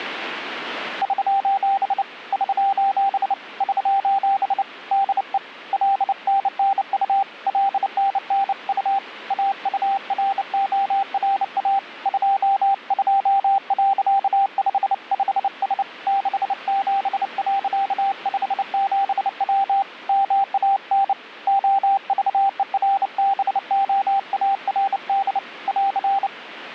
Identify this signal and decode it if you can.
Morse code, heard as a keyed tone, hand-sent with a bug key, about 29 wpm, 790 Hz. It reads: <SOS> <SOS> <SOS> DE LNNU LNNU AURORA 22.55S 67.57W MAN OVERBOARD <AR>